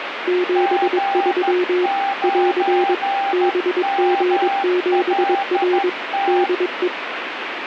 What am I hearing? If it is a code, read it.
Morse code, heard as two keyed tones, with radio static. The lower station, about 22 wpm, 360 Hz: 73 <AR> BG7R DE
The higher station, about 13 wpm, 790 Hz: G9MLT